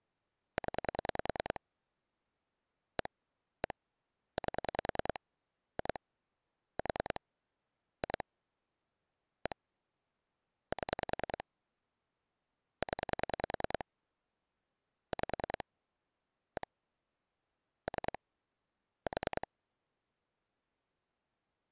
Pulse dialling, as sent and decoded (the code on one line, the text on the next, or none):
10 / 1 / 1 / 8 / 2 / 4 / 2 / 1 / 7 / 10 / 5 / 1 / 3 / 4
0 1 1 8 2 4 2 1 7 0 5 1 3 4